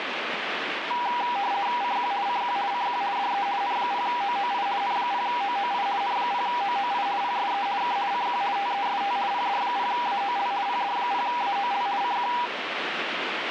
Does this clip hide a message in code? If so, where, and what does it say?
Yes: RTTY (50 baud, 170 Hz shift) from 0.9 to 12.5 s, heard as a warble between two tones, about 880 Hz centre, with radio static. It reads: CQ CQ CQ DE N0OOI N0OOI N0OOI PSE K CQ TEST PD0AOL PD0AOL CQ